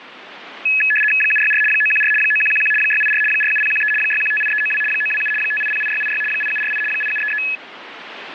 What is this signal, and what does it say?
RTTY (75 baud, 850 Hz shift), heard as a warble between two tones, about 2150 Hz centre, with radio static. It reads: 764 914 9111 684 47013 6158392 927 5808686 8748 8733